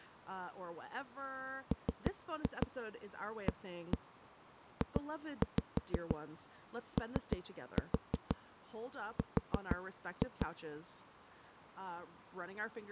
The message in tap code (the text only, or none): MAJOR